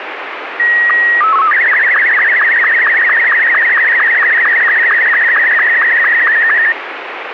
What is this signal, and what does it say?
SSTV (slow-scan television), Martin M2, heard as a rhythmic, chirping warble, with radio static.